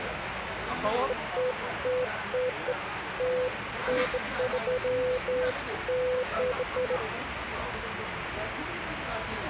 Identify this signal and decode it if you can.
Beeps of irregular length, with radio static and the noise of a crowd indoors. There is no code.